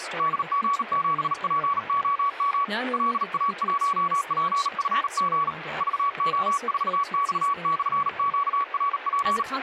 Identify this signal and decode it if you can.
Morse code, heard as a keyed tone, hand-sent with a bug key, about 38 wpm, 1130 Hz, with radio static and speech in English. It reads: DG7POM LA1PFG VO4X/QRP